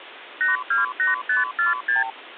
Multi-frequency trunk signalling (R2, with the far end's replies), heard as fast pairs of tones, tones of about 150 ms, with phone line noise. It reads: 828546